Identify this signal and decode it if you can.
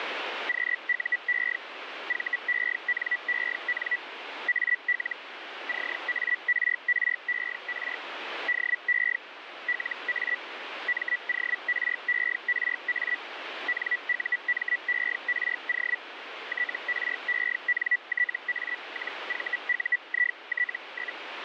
Hellschreiber (Feld-Hell, 122.5 baud), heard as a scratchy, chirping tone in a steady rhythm, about 1950 Hz, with radio static. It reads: QUE VENEN AL CARRER DE LA MORERA NUMERO TRENTA-VUIT?